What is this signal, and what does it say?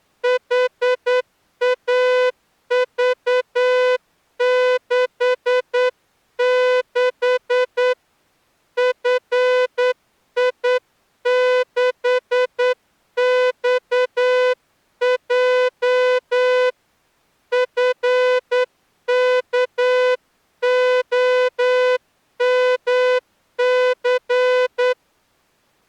Morse code, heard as a horn, hand-sent with a straight key, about 9 wpm. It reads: HAV66 FI6XJ FKOMC